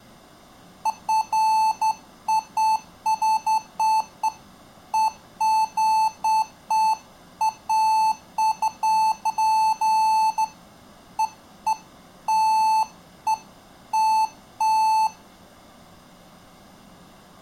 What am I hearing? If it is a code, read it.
Beeps of irregular length, with room echo. There is no code.